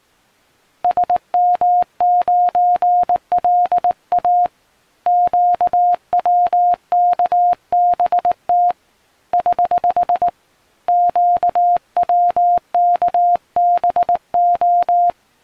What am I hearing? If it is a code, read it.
Morse code, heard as a keyed tone, hand-sent with a paddle, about 19 wpm, 710 Hz. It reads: SM9LA QWKBT <HH> QWKBO